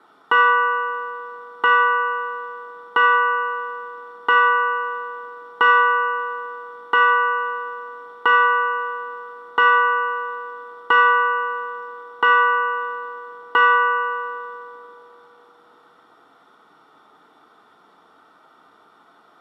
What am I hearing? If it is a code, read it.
Clock strike, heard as a bell, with room echo. 11. Eleven o'clock.